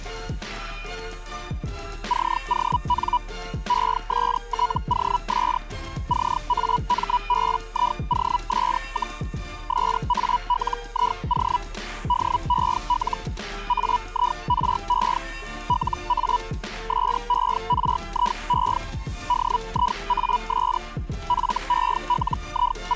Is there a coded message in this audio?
Yes: Hellschreiber (Feld-Hell, 122.5 baud) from 2.1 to 23.0 s, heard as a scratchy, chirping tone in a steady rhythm, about 980 Hz. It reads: CON ESTOS CAMBIOS, SALIO DEL AIRE LA SERIE DIAS …